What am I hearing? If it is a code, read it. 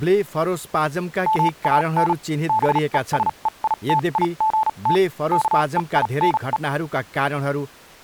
Morse code, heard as a keyed tone, machine-sent, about 37 wpm, spaced as for 30 wpm, 870 Hz, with speech in Nepali. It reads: MAN BESEITIGT KEINE